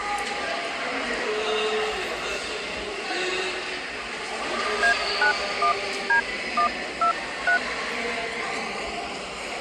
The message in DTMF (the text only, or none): A91D123